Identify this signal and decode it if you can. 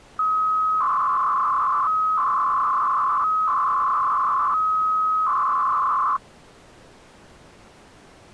300-baud modem data (Bell 103 tones), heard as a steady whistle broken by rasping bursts, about 300 baud, 200 Hz shift.